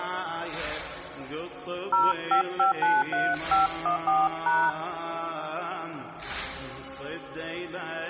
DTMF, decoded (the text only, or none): 05593514#